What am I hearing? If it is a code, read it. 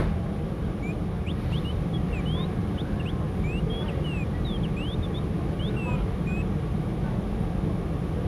Bird-like chirps, with the noise inside a subway train. There is no code.